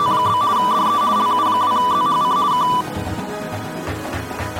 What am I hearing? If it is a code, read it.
RTTY (50 baud, 170 Hz shift), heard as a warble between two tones, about 1080 Hz centre. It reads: … DE LU2ZHC K